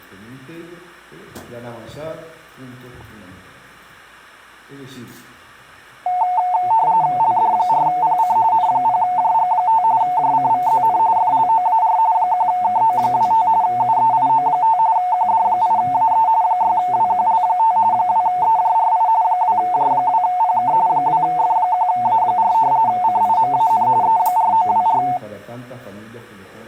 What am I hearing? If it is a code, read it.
RTTY (45.45 baud, 170 Hz shift), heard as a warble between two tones, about 810 Hz centre. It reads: LD4PC N0JG5 JCVZN FLOAR 1KO25 UEIO5 QD8AE 6WQL5 2EJRI 2J2PK 2F1A4 CIMAN E4924